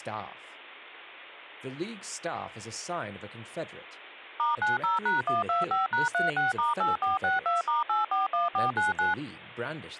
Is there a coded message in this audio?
Yes: DTMF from 4.4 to 9.1 s, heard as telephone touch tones, dialled by machine, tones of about 150 ms, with speech in English. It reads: *90#125#36*8462*841499